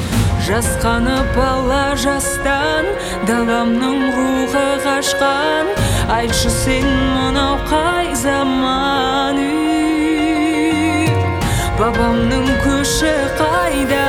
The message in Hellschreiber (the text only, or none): none